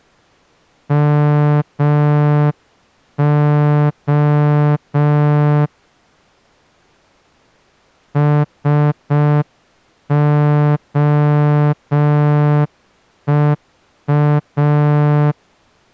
Morse code (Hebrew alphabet), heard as a horn, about 5 wpm. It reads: מה שהוא